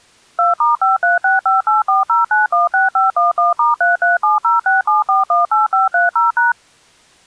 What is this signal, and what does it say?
DTMF, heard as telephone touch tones, dialled by machine, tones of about 150 ms. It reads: 2*5365840916511*337067418530#